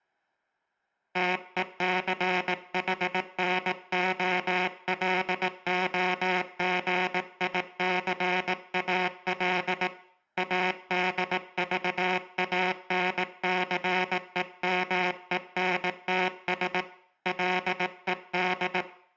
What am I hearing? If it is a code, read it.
Morse code, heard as a buzzer, hand-sent with a paddle, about 18 wpm, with room echo. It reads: TECHNOLOGICAL ADVANCEMENTS LED